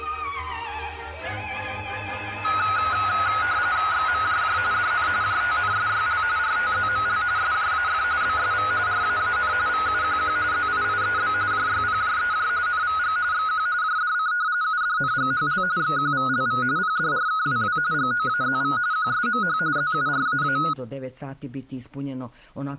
RTTY (45.45 baud, 170 Hz shift), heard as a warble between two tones, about 1360 Hz centre. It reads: XMJJ DN JTNSYL RTZML SJAF BSV RAAN VUQQ ZIIEB JYPJEJ NVG XQ JDC UDNGHL XQVLV PDRKWW GOAZV QSMH ZURAA